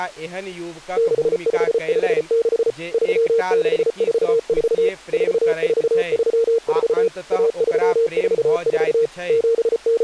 Morse code (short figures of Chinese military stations), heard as a keyed tone, machine-sent, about 34 wpm, 460 Hz, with speech in Maithili. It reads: 6556 3644 4434 1344 …